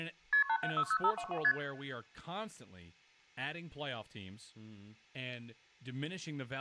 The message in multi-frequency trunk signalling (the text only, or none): KP 8760522 ST